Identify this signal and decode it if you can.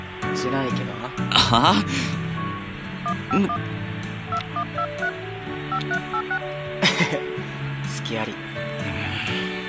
DTMF, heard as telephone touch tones, dialled by hand, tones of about 70 ms, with phone line noise. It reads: 151 2123 5386